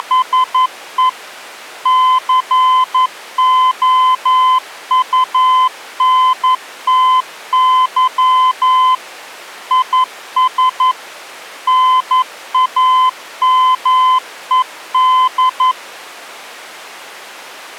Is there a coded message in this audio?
Yes: Morse code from 0.0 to 15.8 s, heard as a keyed tone, machine-sent, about 11 wpm, 1020 Hz. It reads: … COUNTY IS NAMED